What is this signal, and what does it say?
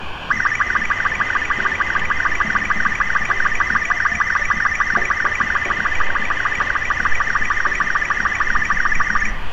SSTV (slow-scan television), Robot 36, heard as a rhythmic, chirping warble, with radio static, room echo and street noise.